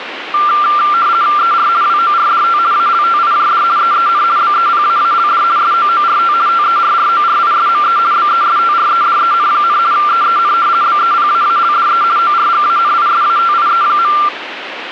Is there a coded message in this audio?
Yes: RTTY (50 baud, 170 Hz shift) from 0.3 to 14.3 s, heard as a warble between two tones, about 1280 Hz centre, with radio static. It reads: ER WORDT ALTIJD EEN BEPAALD SOORT TERRORISME BESTREDEN, EEN BEPAALDE ORGANISATIE.